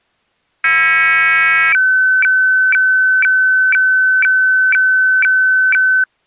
Weather fax (radiofax), 120 lines a minute, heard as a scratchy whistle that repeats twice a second.